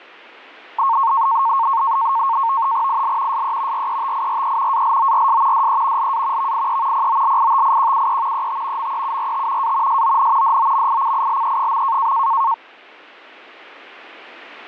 NAVTEX (SITOR-B), 100 baud, 170 Hz shift, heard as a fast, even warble, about 1000 Hz centre. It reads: IL SE RETIRE ALORS DE LA VIE POLITIQUE ET MEURT A SON DOMICILE.